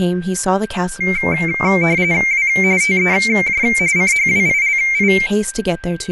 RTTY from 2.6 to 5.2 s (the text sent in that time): TEJ CHWILI